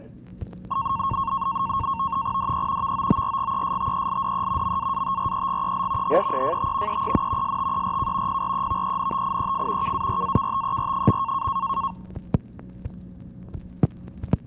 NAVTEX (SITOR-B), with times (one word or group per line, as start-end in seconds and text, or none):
2.4-2.9 DE
2.8-4.8 VOORGESTELDE
4.6-6.2 MAATREGEL
6.0-7.0 HEEFT
6.9-7.6 EEN
7.4-8.4 STERK
8.3-9.9 PREVENTIEF
9.8-11.5 KARAKTER.